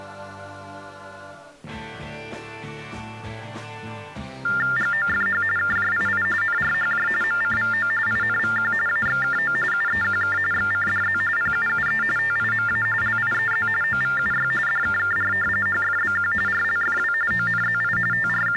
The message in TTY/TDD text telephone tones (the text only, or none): GOFH KJII NRHJ MCVO INVQ AXKO UEQK XCDZ PUUE TIMA LIEZ OVUY DKKR HFBQ RLFW ONZI …